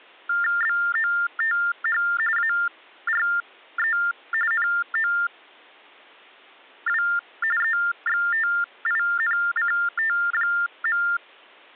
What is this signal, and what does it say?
TTY/TDD text telephone tones (45.45 baud Baudot), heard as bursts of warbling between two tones, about 400 Hz shift, 1600 Hz centre. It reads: BOTH ARE NOW EXTINCT.